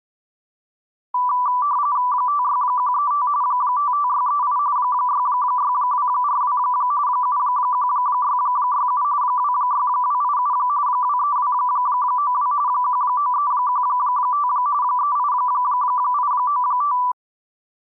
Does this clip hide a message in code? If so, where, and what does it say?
Yes: RTTY (45.45 baud, 170 Hz shift) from 1.1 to 17.1 s, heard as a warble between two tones, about 1080 Hz centre. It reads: 56135 55638 66242 71667 26287 23292 19315 38895